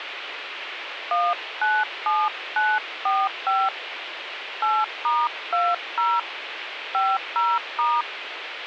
DTMF, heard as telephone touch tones, dialled by hand, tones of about 220 ms, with phone line noise. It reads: 197945 8*20 50*